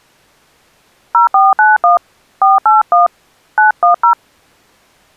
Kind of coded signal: DTMF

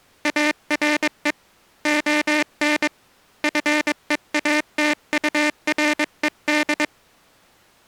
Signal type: Morse code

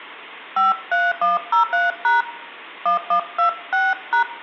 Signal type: DTMF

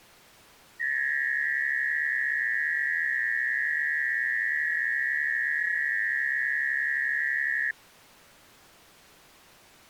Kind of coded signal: FT8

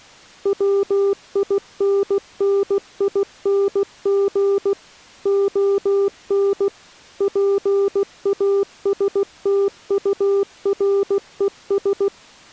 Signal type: Morse code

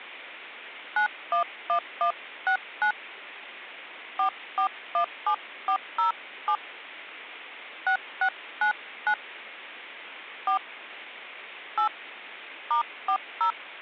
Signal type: DTMF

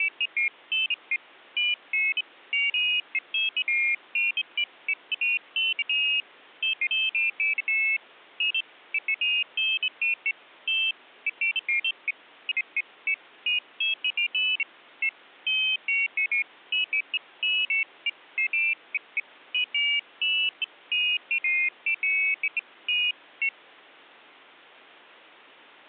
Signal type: none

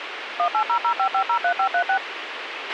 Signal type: DTMF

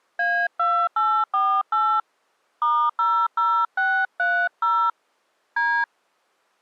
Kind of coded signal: DTMF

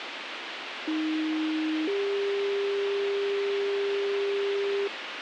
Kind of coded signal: two-tone page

